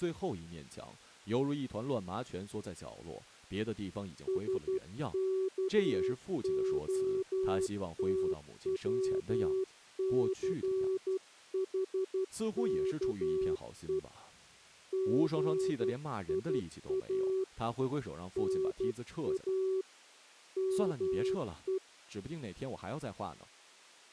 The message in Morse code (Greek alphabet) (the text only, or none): ΣΚΟΤΩΘΗΚΕ ΓΙΑ ΝΑ ΜΕ